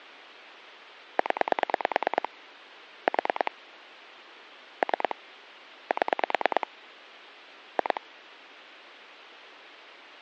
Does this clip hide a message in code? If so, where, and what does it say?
Yes: pulse dialling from 1.2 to 8.0 s, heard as clicks on a phone line, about 9 pulses a second, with phone line noise. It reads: 0 4 3 7 2